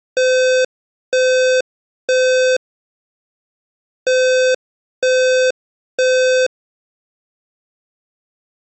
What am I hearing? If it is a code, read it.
Alarm pattern, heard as an alarm's beeps, played twice, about 510 Hz. Temporal three. Smoke or fire, evacuate.